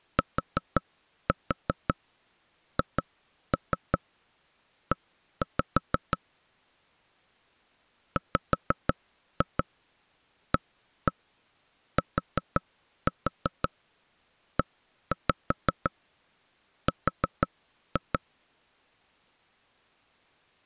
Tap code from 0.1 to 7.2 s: THE

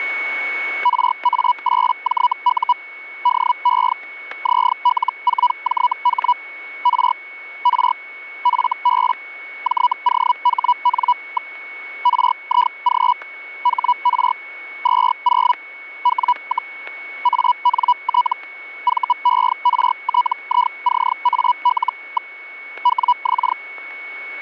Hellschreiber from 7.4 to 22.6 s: R FB JOHN. RIG HR 20 W, ANT VERTICAL.

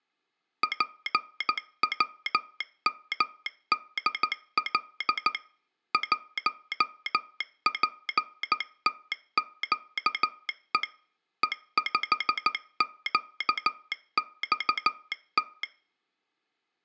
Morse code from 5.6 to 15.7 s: 1PTQE E5QXT

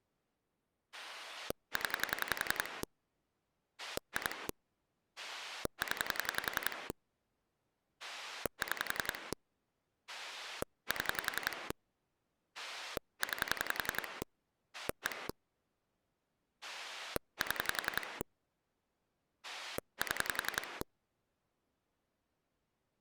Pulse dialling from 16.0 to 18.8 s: 7

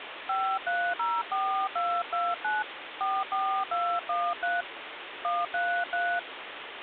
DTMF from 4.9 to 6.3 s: 133

